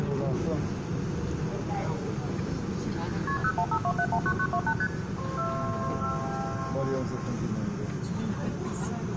Multi-frequency trunk signalling (R1, as on North American trunks), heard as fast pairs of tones, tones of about 70 ms, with room echo and the noise inside a subway train. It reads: KP 0152719928 ST